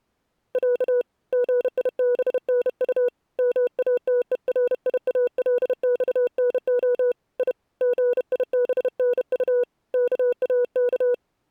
Morse code (Russian alphabet), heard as a keyed tone, hand-sent with a bug key, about 31 wpm, 490 Hz. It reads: Я ГИБНУ МАТЕРИАЛЬНО И ГИБНУ КАК